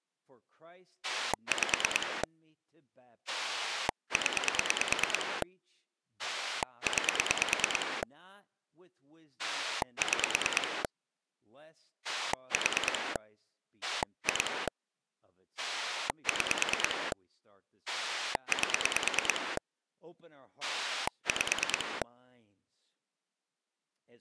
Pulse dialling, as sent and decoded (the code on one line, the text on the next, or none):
5 / 10 / 9 / 6 / 4 / 2 / 6 / 8 / 5
5 0 9 6 4 2 6 8 5